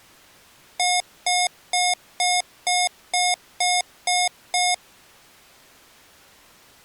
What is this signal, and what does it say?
Beep code, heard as beeps from a small speaker, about 720 Hz. 9 short. In AMI BIOS tables: ROM checksum failure.